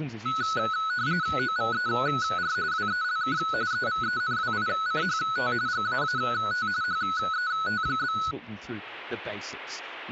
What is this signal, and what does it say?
RTTY (45.45 baud, 170 Hz shift), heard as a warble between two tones, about 1380 Hz centre. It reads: OVER WELK EVENWICHT GAAT HET?